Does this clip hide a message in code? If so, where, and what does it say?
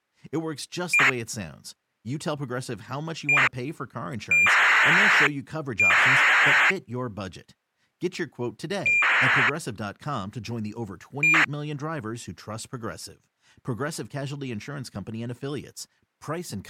Yes: ACARS aircraft data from 0.9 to 11.4 s, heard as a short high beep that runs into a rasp, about 2400 baud, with speech in English.